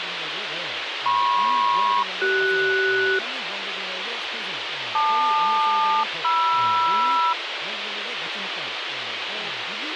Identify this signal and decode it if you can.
Aircraft SELCAL, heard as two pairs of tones, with radio hiss and speech in Korean. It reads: MP-CS LQ-MR